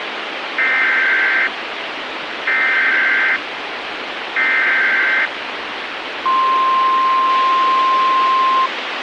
Emergency Alert System (SAME) tones (header bursts, then the 1050 Hz attention tone), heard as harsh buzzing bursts, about 520.83 baud, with radio hiss.